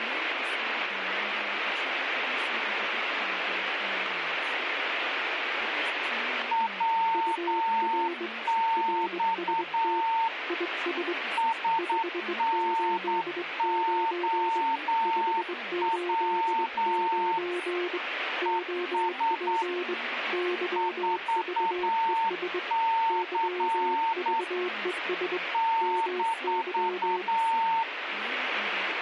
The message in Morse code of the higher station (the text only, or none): WX SNOW ES 4C -